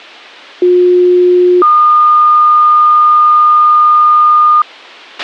Two-tone page, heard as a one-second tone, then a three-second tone, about 360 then 1220 Hz, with a squelch burst at the end.